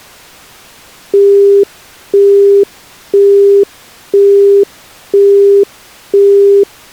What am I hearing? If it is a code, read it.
Telephone call progress tone (single-tone plan, as in Europe, Japan and elsewhere), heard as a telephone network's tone, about 400 Hz, 0.5 s on and 0.5 s off. Busy tone.